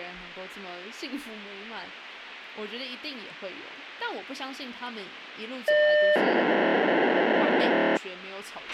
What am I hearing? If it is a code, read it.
POCSAG pager data (1200 baud), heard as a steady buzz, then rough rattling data, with radio hiss, a squelch burst at the end and speech in Chinese.